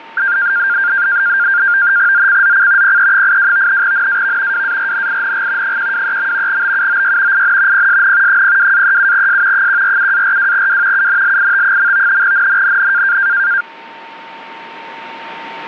NAVTEX (SITOR-B), 100 baud, 170 Hz shift, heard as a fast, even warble, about 1500 Hz centre, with a steady whistle near 910 Hz. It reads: ZCZC PE82 NAV WARNING 123. BUOY IN PSN 02-37S 147-42W UNLIT. NNNN